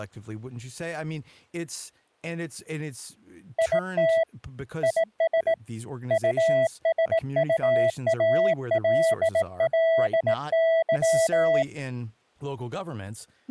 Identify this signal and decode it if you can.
Morse code, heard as a keyed tone, hand-sent with a bug key, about 18 wpm, 660 Hz, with speech in English. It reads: IT IS USUALLY